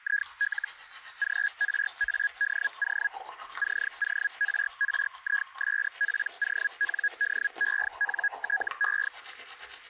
Hellschreiber (Feld-Hell, 122.5 baud), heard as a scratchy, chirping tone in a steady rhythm, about 1650 Hz, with static crashes and the noise of a restroom. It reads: IL GRADO CORRISPONDENTE